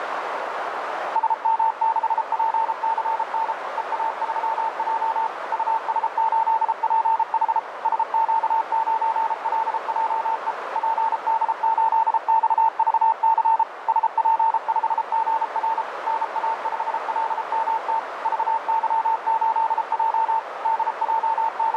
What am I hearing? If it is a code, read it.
Morse code, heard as a keyed tone, machine-sent, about 33 wpm, 900 Hz, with radio static and a narrow filter. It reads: SM6PCN EA3J US8PH SQ9LJE PD8XVC SP5GR NA5LMT VY8J …